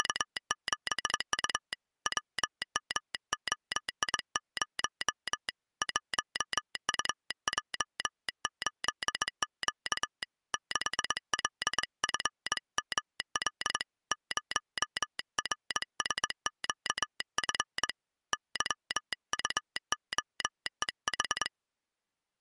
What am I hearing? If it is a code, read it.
Morse code, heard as a telegraph sounder, hand-sent with a straight key, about 22 wpm. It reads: … WMOI0 1UJ8Q 6LFML 0RSQF YUOEH